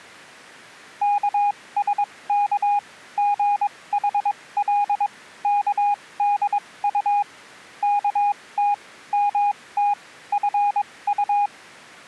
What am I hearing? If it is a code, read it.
Morse code (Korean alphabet), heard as a keyed tone, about 22 wpm, spaced as for 18 wpm, 820 Hz. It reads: 영숙의 어머니